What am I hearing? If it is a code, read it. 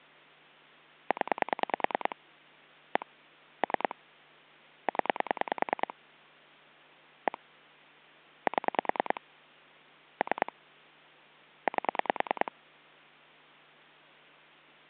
Pulse dialling, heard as clicks on a phone line, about 10 pulses a second. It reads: 0 1 3 0 1 7 3 8